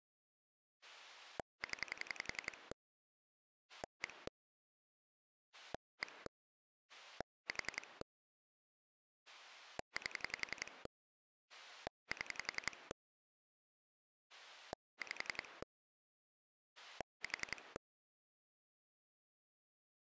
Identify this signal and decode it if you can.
Pulse dialling, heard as a rotary dial, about 11 pulses a second. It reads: 0 1 1 4 8 7 5 4